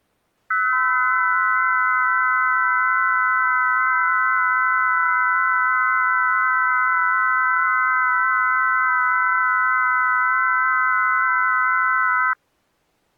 FT8 (several signals at once), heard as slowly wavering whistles, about 6.25 baud.